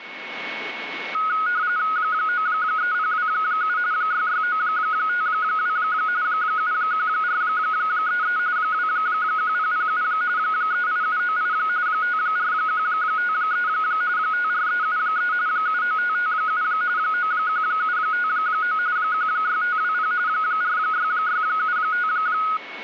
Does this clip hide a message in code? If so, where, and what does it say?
Yes: RTTY (45.45 baud, 170 Hz shift) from 1.1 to 22.6 s, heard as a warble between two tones, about 1360 Hz centre, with a steady whistle near 2210 Hz. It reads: 93027 66952 71433 21007 38798 54153 54373 79557 91759 16520 46675